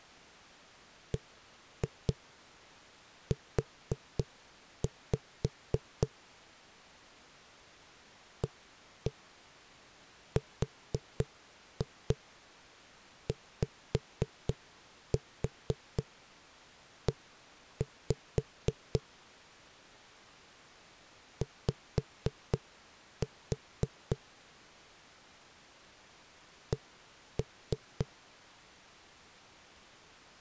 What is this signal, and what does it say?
Tap code, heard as knocks on a wall, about 4 knocks a second. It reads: BU ARYE Y C